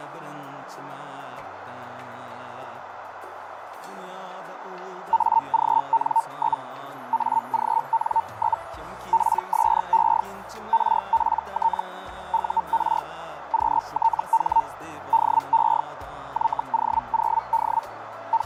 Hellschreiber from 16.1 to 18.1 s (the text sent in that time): YO0D